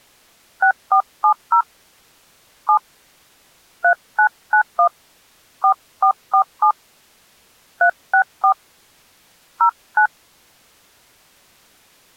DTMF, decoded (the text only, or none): 6470 7 3991 4447 364 09